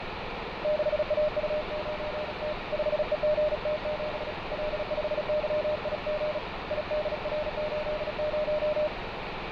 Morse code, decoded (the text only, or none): 6AU9T 5EGT7 L5YIG IDR80